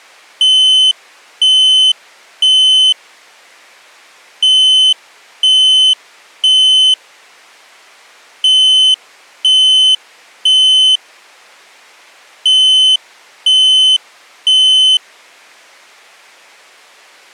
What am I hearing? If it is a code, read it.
Alarm pattern, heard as an alarm's beeps, played four times, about 3050 Hz. Temporal three. Smoke or fire, evacuate.